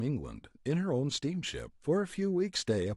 Speech in English. There is no code.